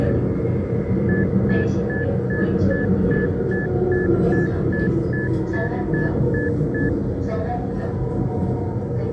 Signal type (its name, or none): none